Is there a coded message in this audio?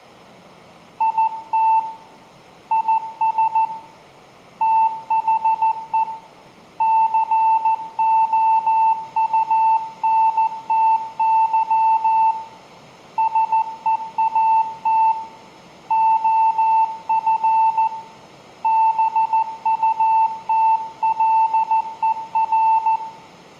Yes: Morse code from 0.9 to 23.0 s, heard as a keyed tone, hand-sent with a paddle, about 14 wpm, 890 Hz, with room echo. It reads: IT IS THE COUNTY SEAT OF BUTLER